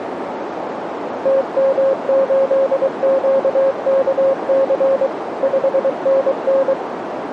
Morse code, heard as a keyed tone, machine-sent, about 23 wpm, 540 Hz, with radio static and a narrow filter. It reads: TM8QKC 5NN